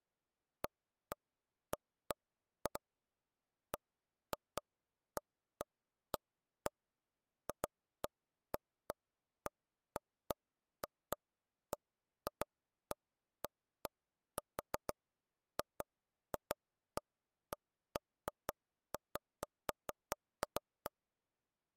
Irregular taps on a table. There is no code.